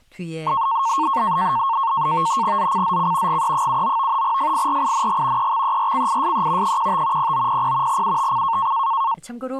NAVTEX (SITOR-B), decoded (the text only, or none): ZCZC GE79 FIRING EXERCISE 15 0900 UTC